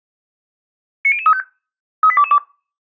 Five-tone selective call (ZVEI), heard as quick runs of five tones, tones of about 70 ms. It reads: 90035 38222